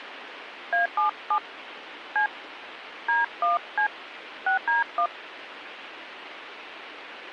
DTMF, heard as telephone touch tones, dialled by hand, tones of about 120 ms, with radio hiss. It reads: A77 C D1C 6D1